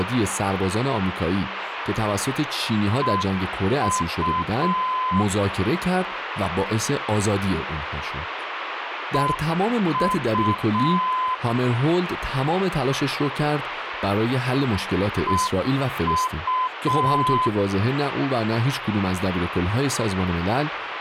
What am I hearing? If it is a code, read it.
Morse code, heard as a keyed tone, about 6 wpm, 1020 Hz, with radio static and speech in Persian. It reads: EU EU EU